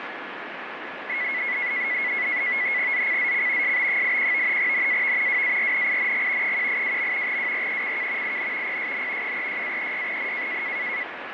NAVTEX (SITOR-B), 100 baud, 170 Hz shift, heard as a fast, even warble, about 2100 Hz centre, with radio static. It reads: ZCZC SB81 NAV WARNING 182. WRECK IN PSN 36-36N